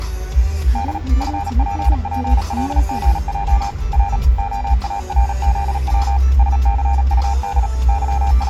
Morse code, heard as a keyed tone, machine-sent, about 37 wpm, 800 Hz, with the noise inside a car. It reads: D FPPLGJ R OARZW SCUD …